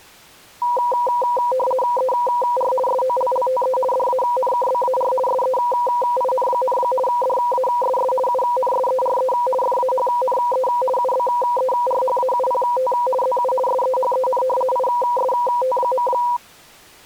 RTTY (50 baud, 450 Hz shift), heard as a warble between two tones, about 740 Hz centre. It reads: ER SOLLTE DANKBAR SEIN, DASS UNSERE FAHNE UBERHAUPT ZU SEHEN IST.